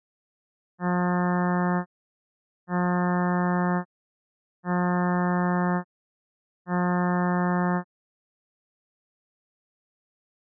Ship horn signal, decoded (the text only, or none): 4 short